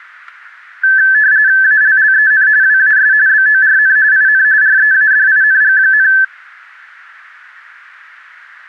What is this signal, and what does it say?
RTTY (45.45 baud, 170 Hz shift), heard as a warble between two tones, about 1650 Hz centre, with static crashes. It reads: ALLEN WAS BORN IN READING,